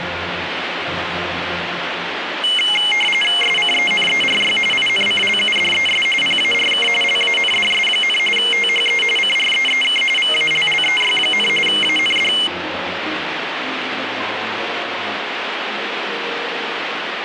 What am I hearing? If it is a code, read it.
RTTY (45.45 baud, 850 Hz shift), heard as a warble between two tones, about 2550 Hz centre, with radio static. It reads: SCENERY INCLUDES PARK LANDS, THE CREEK VALLEY, AND